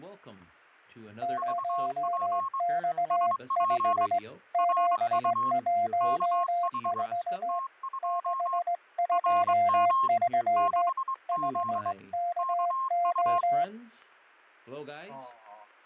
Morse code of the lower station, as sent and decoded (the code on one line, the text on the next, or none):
----- -..- ..... / --... .---- ....- / -.... ..--- ...-- / ..... -.- ---
0X5 714 623 5KO